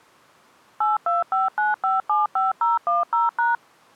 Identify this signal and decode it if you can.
DTMF, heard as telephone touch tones, dialled by machine, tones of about 160 ms. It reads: 8259575010#